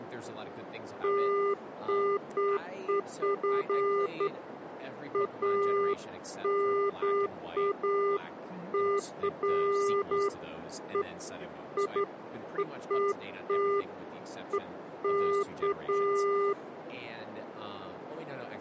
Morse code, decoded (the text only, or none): none